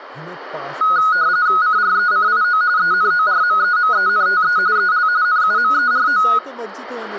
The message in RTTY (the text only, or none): CRECIO ENORMEMENTE EL NUMERO